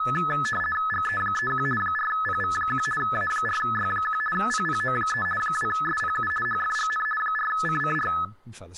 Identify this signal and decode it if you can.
RTTY (50 baud, 450 Hz shift), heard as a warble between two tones, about 1500 Hz centre, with speech in English. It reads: GE31 4PV1 A4Y1 PPO3 2SPU HFGN 4CCR